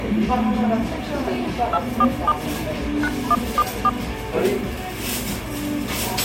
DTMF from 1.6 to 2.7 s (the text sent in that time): 247